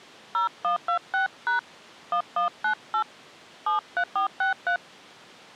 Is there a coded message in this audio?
Yes: DTMF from 0.3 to 4.8 s, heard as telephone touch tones, dialled by hand, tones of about 110 ms. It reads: 0126# 1198 73463